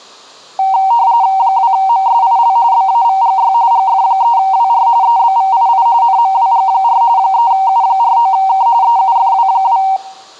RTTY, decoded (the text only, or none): 2MSIL BAVGY GF3WR EBVII NMWG4 3U49K EUFW2